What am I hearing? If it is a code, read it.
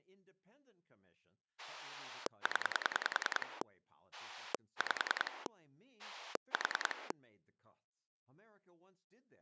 Pulse dialling, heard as a rotary dial, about 10 pulses a second, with speech in English. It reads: 0 5 4